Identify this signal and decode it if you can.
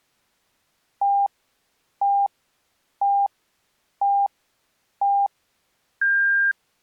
Radio time signal (five pips and a higher one, as on Chinese radio), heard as pips.